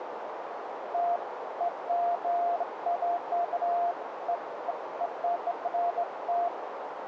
Beeps of irregular length, with radio static and a narrow filter. There is no code.